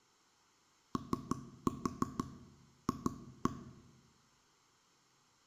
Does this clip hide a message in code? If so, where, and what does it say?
Yes: tap code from 1.0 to 3.5 s, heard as knocks on wood, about 6 knocks a second, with room echo. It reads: OF